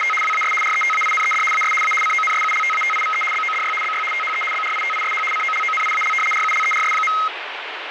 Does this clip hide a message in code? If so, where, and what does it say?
Yes: RTTY (75 baud, 850 Hz shift) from 0.0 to 7.3 s, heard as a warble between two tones, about 1700 Hz centre, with radio static. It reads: … WAS RETAINED AS A CONSULTATIVE BODY BY THE BRITISH COLONIAL RULERS.